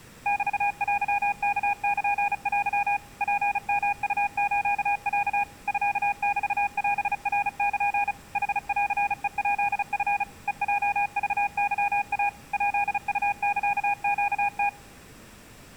Morse code (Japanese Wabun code), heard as a keyed tone, machine-sent, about 35 wpm, 810 Hz. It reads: メテワルテ ツヨウスロ ミメオナル ヌンヘヱチ ヘヲクケイ ヱウサネム